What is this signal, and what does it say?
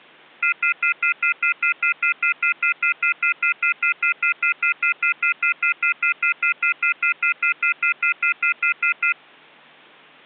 Telephone call progress tone (North American plan), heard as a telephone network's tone, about 1400, 2050, 2450, 2600 Hz, 0.1 s on and 0.1 s off. Off-hook warning tone.